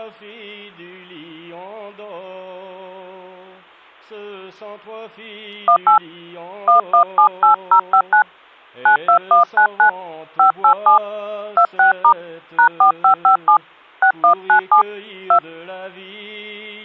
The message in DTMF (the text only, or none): 18 1178059 92199 587 26* #4557 6197 2